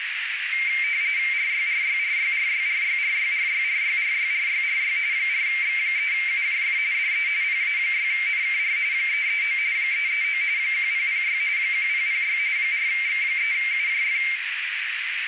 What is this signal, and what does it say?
RTTY (45.45 baud, 170 Hz shift), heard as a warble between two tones, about 2200 Hz centre, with radio static and a narrow filter. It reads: RYRYRYRYRYRYRYRYRYRYRY 4X3UJF DE PA6NKR 339 339 1006 1006 4X3UJF